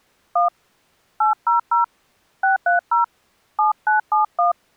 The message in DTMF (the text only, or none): 1 800 630 7971